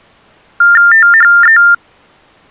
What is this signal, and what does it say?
TTY/TDD text telephone tones (45.45 baud Baudot), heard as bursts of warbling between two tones, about 400 Hz shift, 1600 Hz centre. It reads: THE